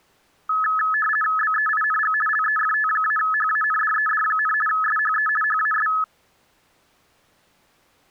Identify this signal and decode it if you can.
RTTY (50 baud, 450 Hz shift), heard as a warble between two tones, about 1500 Hz centre. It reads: BEING LEFT-HANDED, SHE HAS